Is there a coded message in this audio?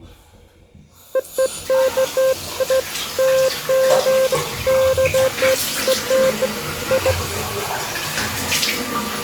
No, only beeps of irregular length, with the noise of a restroom.